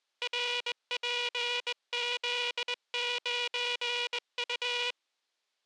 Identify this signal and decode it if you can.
Morse code, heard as a buzzer, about 20 wpm. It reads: RPZ9U